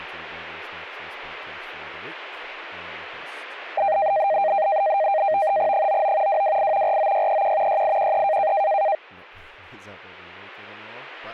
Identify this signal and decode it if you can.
NAVTEX (SITOR-B), 100 baud, 170 Hz shift, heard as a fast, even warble, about 710 Hz centre, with speech in English. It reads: 99 228 49631 6813